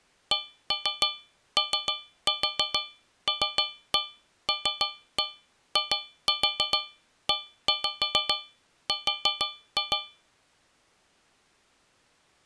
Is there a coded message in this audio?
Yes: tap code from 0.3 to 10.3 s, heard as taps on a metal pipe, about 6 knocks a second. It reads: COLLIER